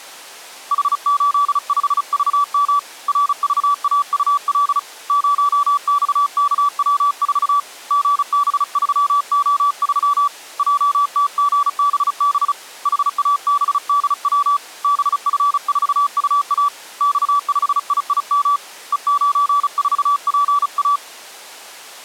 Morse code, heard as a keyed tone, hand-sent with a paddle, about 35 wpm, 1150 Hz. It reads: H85VM RVAUL 0XKW4 GB3O3 JTGBB HABDW BF4UA X5IIM E94PA